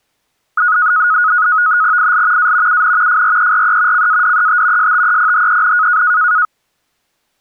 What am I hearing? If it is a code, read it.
NAVTEX (SITOR-B), 100 baud, 170 Hz shift, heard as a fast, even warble, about 1360 Hz centre. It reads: IL A UN FRERE CADET STEPHEN